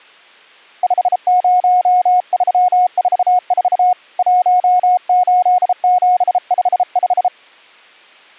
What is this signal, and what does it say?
Morse code, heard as a keyed tone, hand-sent with a bug key, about 33 wpm, 730 Hz. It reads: 50344 18755